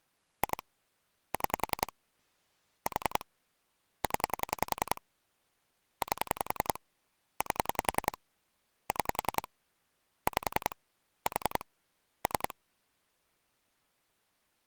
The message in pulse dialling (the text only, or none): 2 6 4 0 8 8 6 5 4 3